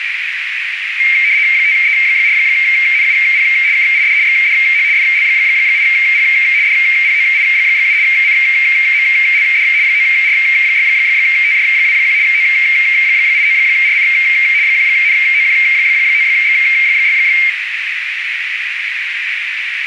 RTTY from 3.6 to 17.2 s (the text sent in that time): KID XDH FL8P DPOI7 CMLD 9R6TJ21 O89RC 1NOQ9X6